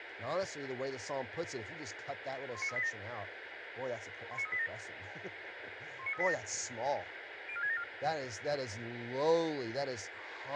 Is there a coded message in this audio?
Yes: five-tone selective call (ZVEI) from 2.5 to 7.8 s, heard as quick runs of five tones, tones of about 70 ms, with radio hiss, a squelch burst at the end and speech in English. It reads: 19387 19387 19387 04674